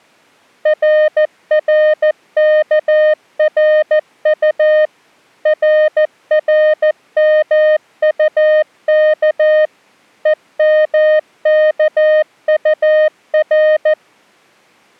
Morse code, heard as a keyed tone, machine-sent, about 14 wpm, 620 Hz. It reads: RRKRU RRMUK EMKUR